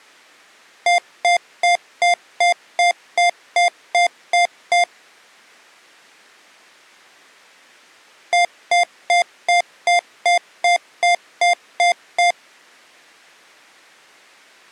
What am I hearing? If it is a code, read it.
Beep code, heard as beeps from a small speaker, played twice, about 700 Hz. 11 short. In AMI BIOS tables: cache memory error.